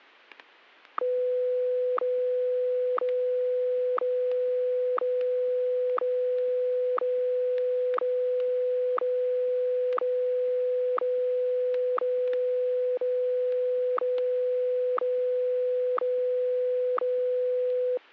Radio time signal (WWVH, Hawaii), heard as ticks, one a second, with static crashes.